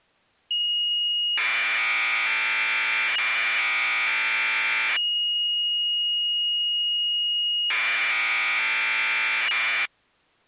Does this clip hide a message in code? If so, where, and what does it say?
Yes: Commodore tape loading (standard loader) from 0.5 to 9.9 s, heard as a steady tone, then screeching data.